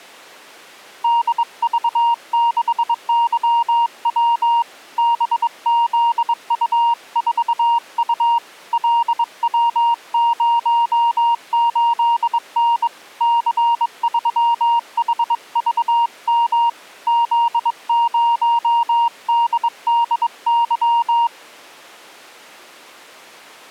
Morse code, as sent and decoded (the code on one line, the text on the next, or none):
-.. ...- -.... -.-- .-- / -... --.. ..- ....- ..- / .-.. .-- ----- ---.. -. / -.-. ...-- .... ...- -- / --.. ----- -.. -.. -.--
DV6YW BZU4U LW08N C3HVM Z0DDY